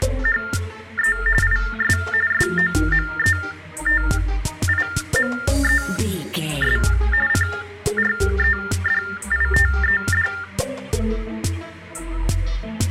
TTY/TDD text telephone tones (45.45 baud Baudot), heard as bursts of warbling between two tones, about 400 Hz shift, 1600 Hz centre. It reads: … IS SOMETIMES CREDITED